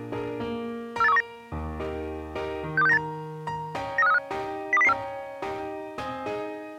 Five-tone selective call (EEA), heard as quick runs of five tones, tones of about 40 ms. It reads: 48319 62698 93535 02004